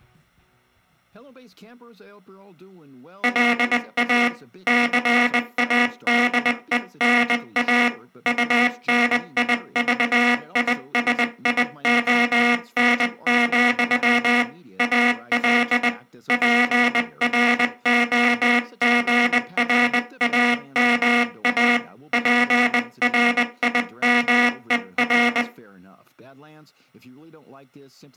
Morse code, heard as a buzzer, hand-sent with a bug key, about 20 wpm. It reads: LA CADENA UNIVISION, AL PROGRAMA PRIMER